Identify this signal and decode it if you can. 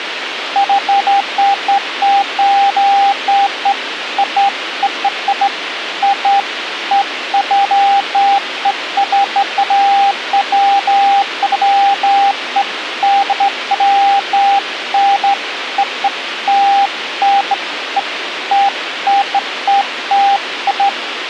Beeps of irregular length, with radio hiss and a squelch burst at the end. There is no code.